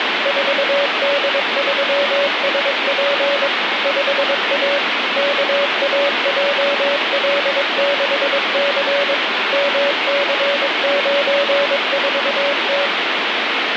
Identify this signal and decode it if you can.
Morse code, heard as a keyed tone, machine-sent, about 22 wpm, 570 Hz, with heavy radio static. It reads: 4D3SP 5A KAJL6C MC94T